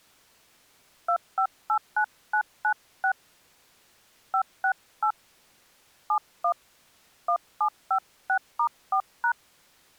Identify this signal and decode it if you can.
DTMF, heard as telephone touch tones, dialled by hand, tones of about 80 ms. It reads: 2589996 568 71 1756*4#